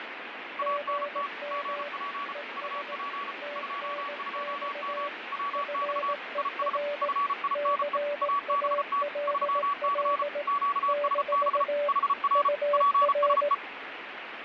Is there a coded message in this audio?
Yes: Morse code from 0.5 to 13.6 s, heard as two keyed tones, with radio static and fading. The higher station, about 34 wpm, 1130 Hz: ANT GP UP 22M WX IS FINE ABT 3C QSB HR PSE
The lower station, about 18 wpm, 580 Hz: GM ES TNX FER CALL - UR